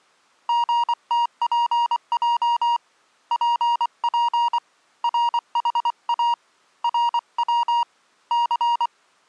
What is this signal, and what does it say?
Morse code, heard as a keyed tone, hand-sent with a paddle, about 24 wpm, 950 Hz. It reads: GTPJ PP RHA RW C